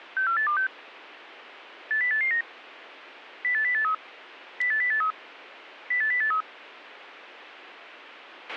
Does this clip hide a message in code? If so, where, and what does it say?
Yes: five-tone selective call (CCIR) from 0.2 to 6.4 s, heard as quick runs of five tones, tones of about 100 ms, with a squelch burst at the end. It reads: 64826 80889 08083 08083 08083